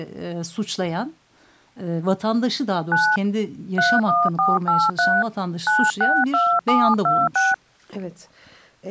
DTMF, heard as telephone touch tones, dialled by hand, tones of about 220 ms, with speech in Turkish. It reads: 9 31483 962726